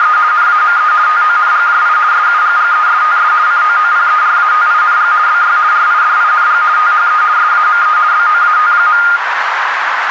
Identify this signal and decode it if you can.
RTTY (50 baud, 170 Hz shift), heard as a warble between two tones, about 1320 Hz centre, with radio static and a narrow filter. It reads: … NAME TONGJI SUGGESTS COOPERATING BY RIDING THE SAME BOAT.